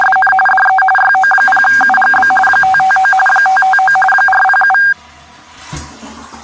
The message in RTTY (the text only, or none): … DE YO0UGB 559 559 407